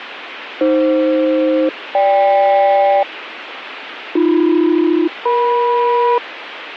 Aircraft SELCAL, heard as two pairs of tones, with radio static. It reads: AF-GK AB-EM